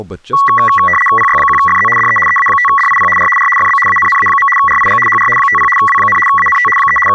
RTTY (75 baud, 850 Hz shift), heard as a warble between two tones, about 1550 Hz centre, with speech in English. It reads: PY1FZ DE EA5DIP R R FB ANNA. RIG HR 50 W, ANT 3 …